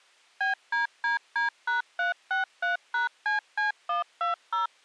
DTMF, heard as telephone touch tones, dialled by machine, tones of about 130 ms. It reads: BDDD#363#CC120